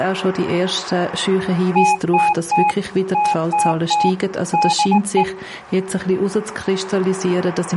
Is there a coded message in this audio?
Yes: Morse code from 1.7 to 5.3 s, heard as a keyed tone, machine-sent, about 19 wpm, 840 Hz. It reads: TTT TTT DE